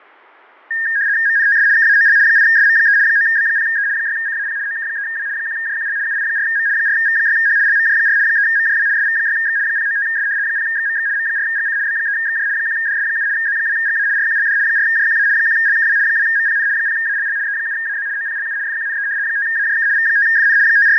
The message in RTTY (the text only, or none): MNTS KAOL 8SM3 9B0E 6CAP OK3W 1JQL UI4M 4V6H LMJ4 3MJW SV6X 095S 0XMX M4GC B3XJ 1DS7 Z2GA RQLD 4JQA 1LKW 2MPN 0ALL E7AZ OPLU FQNE 5AJK V5FN …